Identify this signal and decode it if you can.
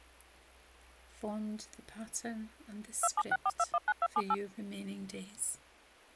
DTMF, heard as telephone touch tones, dialled by machine, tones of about 50 ms. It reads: 2764219278